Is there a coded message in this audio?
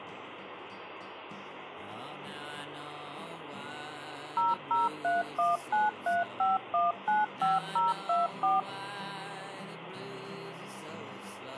Yes: DTMF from 4.4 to 8.6 s, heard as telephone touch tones, dialled by machine, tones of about 170 ms, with phone line noise. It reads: 0031935195024